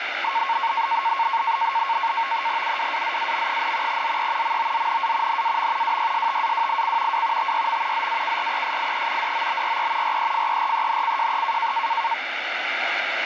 NAVTEX (SITOR-B), 100 baud, 170 Hz shift, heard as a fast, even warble, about 1000 Hz centre, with radio static. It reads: UWAZAM, ZE MOZNA NAM WYSTAWIC W TYM ZAKRESIE DOBRE REFERENCJE